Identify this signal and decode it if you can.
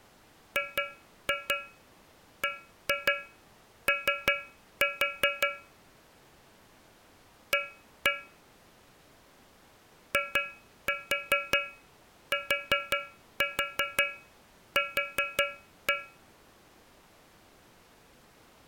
Tap code, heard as taps on a metal pipe, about 5 knocks a second. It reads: GBO A ITQ